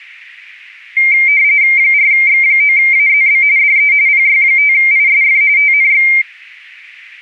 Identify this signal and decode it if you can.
RTTY (45.45 baud, 170 Hz shift), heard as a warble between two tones, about 2200 Hz centre. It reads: 4X9AZB DE PY5ISF TNX